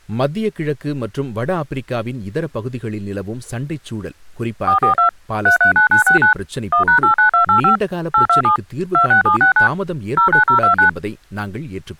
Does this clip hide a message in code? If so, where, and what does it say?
Yes: DTMF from 4.7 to 10.9 s, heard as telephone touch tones, dialled by machine, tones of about 110 ms, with speech in Tamil. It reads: 442 339969 1#89285 827 26769 09029